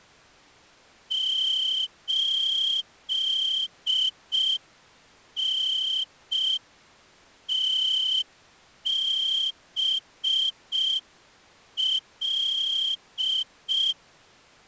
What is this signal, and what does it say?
Morse code, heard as a whistle, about 5 wpm. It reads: 8NTBL